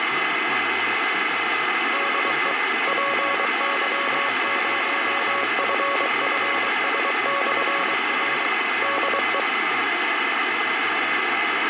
Morse code, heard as a keyed tone, machine-sent, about 23 wpm, 560 Hz, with radio static, fading, a steady whistle near 2040 Hz and speech in English. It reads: DE PY0FFS/R DE